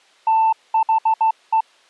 Morse code, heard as a keyed tone, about 16 wpm, 890 Hz. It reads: THE